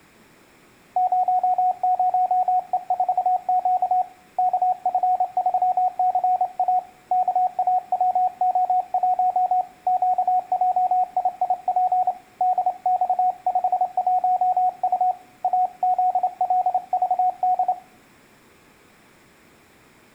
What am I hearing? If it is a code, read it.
Morse code, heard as a keyed tone, hand-sent with a straight key, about 28 wpm, 730 Hz, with room echo. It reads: 00E4Q KF3CA KAWO1 QJIIP DX51U AZLVD